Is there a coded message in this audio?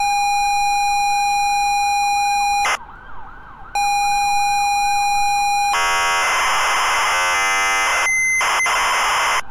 Yes: ZX Spectrum tape loading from 0.0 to 9.4 s, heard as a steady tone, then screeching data, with street noise.